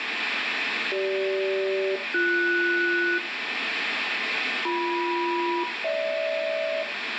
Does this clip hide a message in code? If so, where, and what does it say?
Yes: aircraft SELCAL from 0.9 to 6.8 s, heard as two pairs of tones, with radio static and room echo. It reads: CG-BS BM-GH